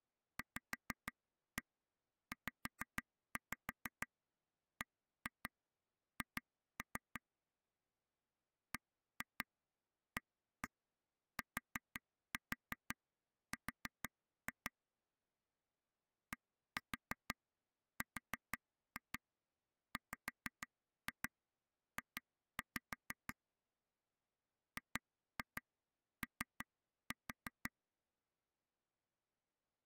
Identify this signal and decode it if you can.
Tap code, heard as taps on a table, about 6 knocks a second. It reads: VZBH BATR DRWJ GO